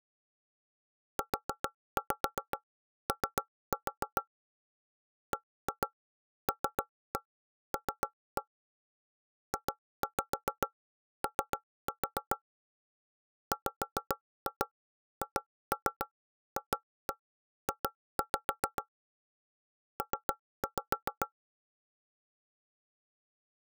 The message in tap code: UO BLL JO WHFJ P

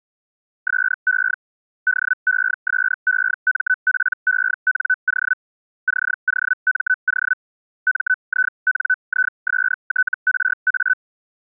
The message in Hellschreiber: SE DESEMPENO COMO MINISTRA

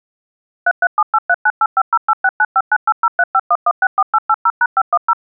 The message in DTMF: 3378398508695980351164880#510

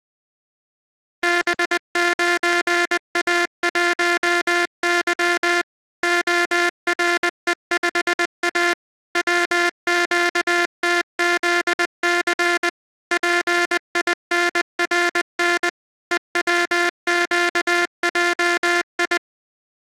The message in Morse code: B9A1Y ORE5A WQTZC PINRN EWQJI

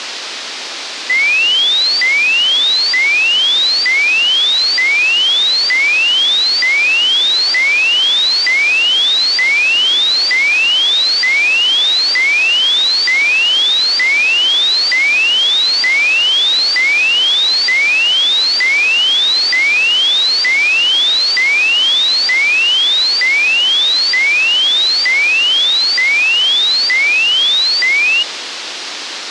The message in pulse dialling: none

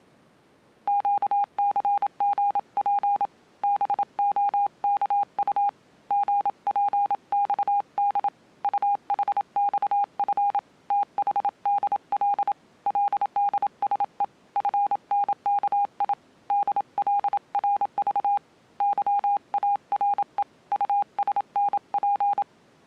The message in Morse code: QCGP BOKU GPXD UHXF THDL LDSE FNKI DLRV YARE USNP

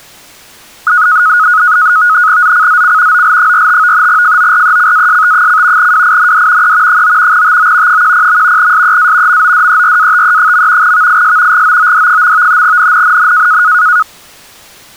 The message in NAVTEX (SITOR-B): ZCZC OL45 FORECAST: WIND E 9 TO 10. SEA MODERATE. VIS GOOD. NNNN

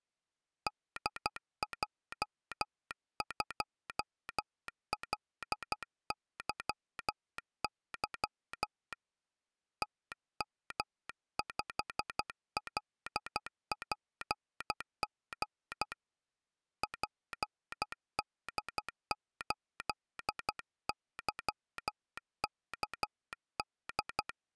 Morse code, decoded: DJ2LYY TM5LPG PD8YKD

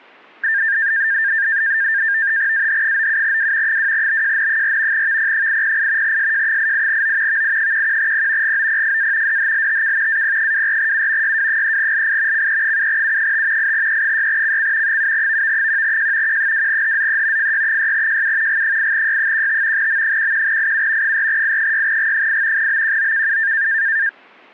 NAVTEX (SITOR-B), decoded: AH97W 2BJN4 VP808 SJ88O VI11P GOPFA DHLTK AP24U YW3LI CE7U5 8E6CC 7VV1J Q2HZE FY6JU G8Y15 M11IU 4I6G8 BQOKU

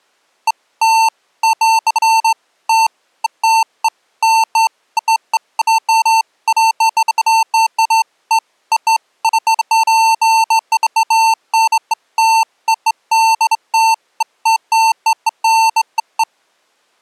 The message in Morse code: none

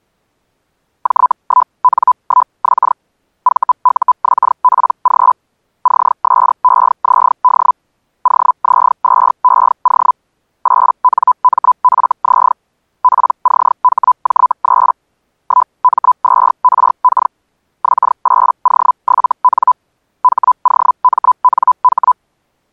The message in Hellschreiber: J1N1X VUXPG CSEZD OZ2EO 8NMFZ PCHJ3 1M2RK X8O7N HOMNH

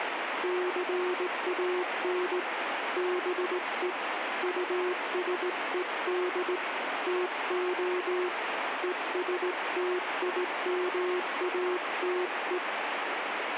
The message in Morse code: CAN BE USED TO ESTIMATE

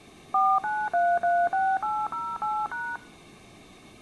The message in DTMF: 49336808#

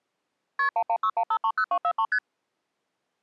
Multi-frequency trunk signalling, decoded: KP 1161530243 ST

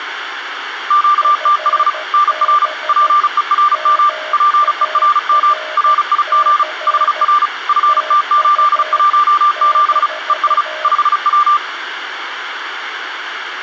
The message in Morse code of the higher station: QTH NR PERM PERM RIG HR FT817 ES 5W

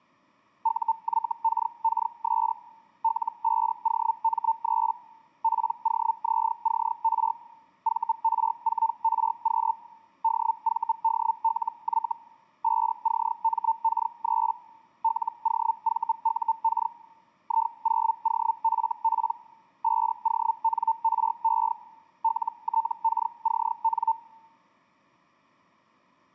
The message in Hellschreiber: UYKKS L5OM3 POZCR VR4RQ DVDLY 5CMK3 LOVUK I0OFP 5ONRE LTKCN

